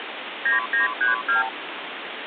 Multi-frequency trunk signalling (R2, with the far end's replies), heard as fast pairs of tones, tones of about 140 ms, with phone line noise. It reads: 9932